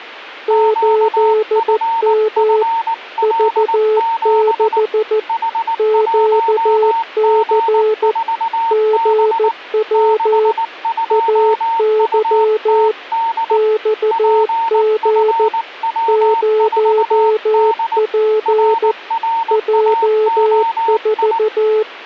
Morse code, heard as two keyed tones. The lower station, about 14 wpm, 430 Hz: 8M V6 QC GW AY XG 0P J4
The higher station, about 19 wpm, 910 Hz: QFFL7 H1G4B 62UTD PFW4D RRAOI